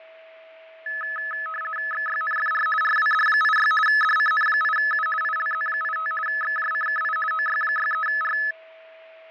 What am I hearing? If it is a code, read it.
RTTY (50 baud, 450 Hz shift), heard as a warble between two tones, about 1500 Hz centre, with fading and a steady whistle near 650 Hz. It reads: XYNFR RWD86 DCN8U ILZ85 XJCKI OY63R